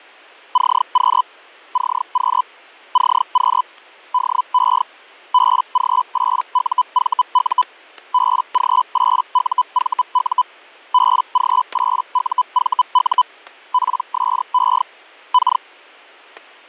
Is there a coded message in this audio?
Yes: Hellschreiber (Feld-Hell, 122.5 baud) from 0.5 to 15.6 s, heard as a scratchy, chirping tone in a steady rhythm, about 1000 Hz, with static crashes. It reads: CQ CQ CQ DE BG8UVU BG8UVU BG8UVU PSE K